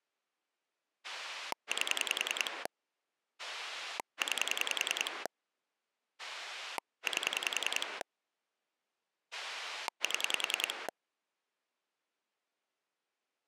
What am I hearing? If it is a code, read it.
Pulse dialling, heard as a rotary dial, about 10 pulses a second. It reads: 8 9 8 7